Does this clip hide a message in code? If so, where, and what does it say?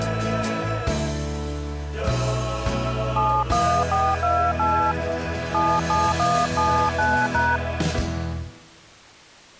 Yes: DTMF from 3.2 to 7.6 s, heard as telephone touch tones, dialled by hand, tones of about 250 ms. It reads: 71428 77179#